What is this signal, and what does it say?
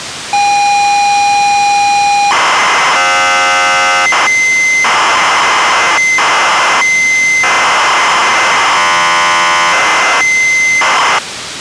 ZX Spectrum tape loading, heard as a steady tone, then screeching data, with tape hiss.